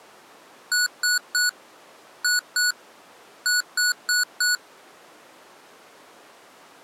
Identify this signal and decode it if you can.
Beep code, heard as beeps from a small speaker, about 1470 Hz. 3-2-4. In Phoenix BIOS tables: keyboard controller failure.